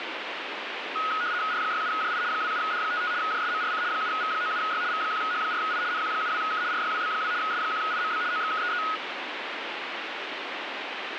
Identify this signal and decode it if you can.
RTTY (75 baud, 170 Hz shift), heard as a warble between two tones, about 1360 Hz centre, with radio static. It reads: R67JI 27D55 JSMRC 7V97Y V1H4I NQ72K RYWB2 S1IMB OXKEE